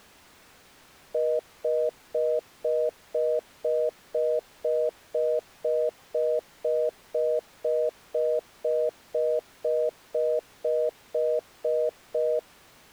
Telephone call progress tone (North American plan), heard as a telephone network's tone, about 480, 620 Hz, 0.25 s on and 0.25 s off. Congestion tone.